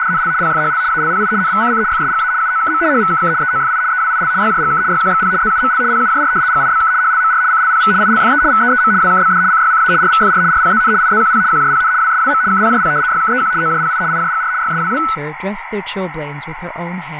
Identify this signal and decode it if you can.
RTTY (75 baud, 170 Hz shift), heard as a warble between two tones, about 1400 Hz centre, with radio static, a narrow filter and speech in English. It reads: … PFHL ALPI NVCC FSGA UOKM HVKK EOFI EWIL YJGK YQXP ZUML PUJR GIBK HLMR CLPV ILFE VEEM WKBD CYCA RVFR RPZN IZQP QJPN WSWM KPJP YKEQ OJPI IJGR YSWW